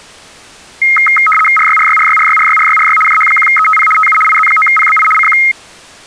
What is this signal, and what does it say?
RTTY (75 baud, 850 Hz shift), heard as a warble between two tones, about 1700 Hz centre. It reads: RYRYRYRYRYRYRY JH1ETP TU IZ9PBI CQ